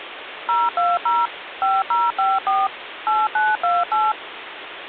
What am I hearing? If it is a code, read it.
DTMF, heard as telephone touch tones, dialled by machine, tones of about 200 ms, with phone line noise. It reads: 020 5054 8928